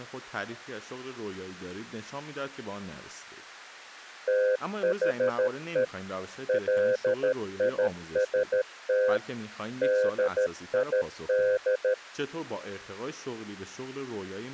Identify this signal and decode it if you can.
Morse code, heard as a keyed tone, machine-sent, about 13 wpm, 510 Hz, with speech in Persian. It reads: THE LIST DID